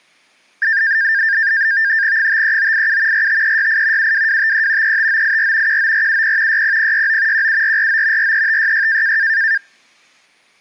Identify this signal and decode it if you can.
NAVTEX (SITOR-B), 100 baud, 170 Hz shift, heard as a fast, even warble, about 1700 Hz centre. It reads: 53987 45368 72253 35984 19470 60069 17449 43566